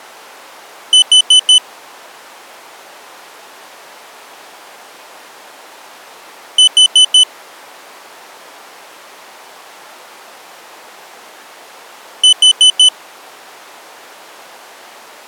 Alarm pattern, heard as an alarm's beeps, played three times, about 3000 Hz. Temporal four. Carbon monoxide.